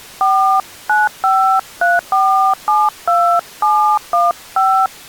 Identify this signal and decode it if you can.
DTMF, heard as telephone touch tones, dialled by hand, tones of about 300 ms. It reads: 4953472715